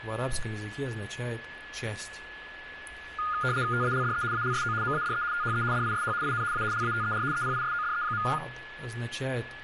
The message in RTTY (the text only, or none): TALDE ALSO MADE THE DISH IN A LATER EPISODE.